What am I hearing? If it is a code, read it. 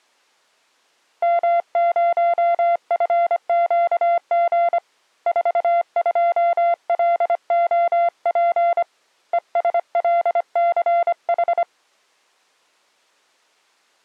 Morse code, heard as a keyed tone, hand-sent with a paddle, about 25 wpm, 690 Hz. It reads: M0FQG 42LOP ESLCH